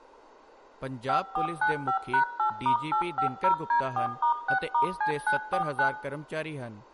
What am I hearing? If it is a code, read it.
DTMF, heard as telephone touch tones, dialled by machine, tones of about 100 ms, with room echo and speech in Punjabi. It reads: 5495#8*850D4*6*C949